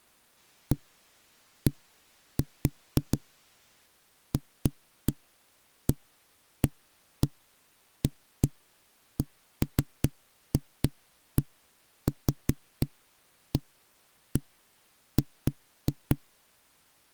Irregular knocks on a wall. There is no code.